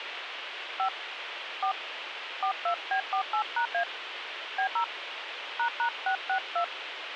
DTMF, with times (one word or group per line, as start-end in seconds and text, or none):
0.8-0.9 5
1.6-1.7 4
2.4-3.8 42B48#A
4.6-4.8 B0
5.6-6.6 ##662